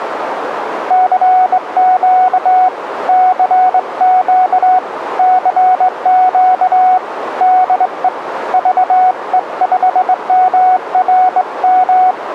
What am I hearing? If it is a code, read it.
Morse code, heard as a keyed tone, hand-sent with a straight key, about 21 wpm, 740 Hz, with radio static and a narrow filter. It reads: CQ CQ CQ DE VE5MRM